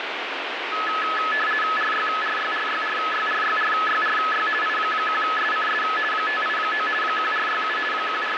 RTTY (50 baud, 450 Hz shift), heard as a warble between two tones, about 1500 Hz centre, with radio static. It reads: RYRYRYRYRYRYRY I1SCS 589 1467 …